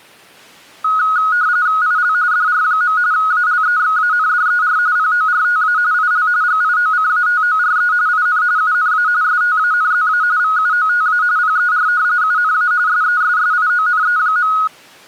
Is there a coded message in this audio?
Yes: RTTY (45.45 baud, 170 Hz shift) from 0.8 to 14.7 s, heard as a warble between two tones, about 1360 Hz centre. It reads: IL DR. ALEXANDER PORTA IL GIOCATORE IN UNA STANZA VUOTA PER UNA SESSIONE.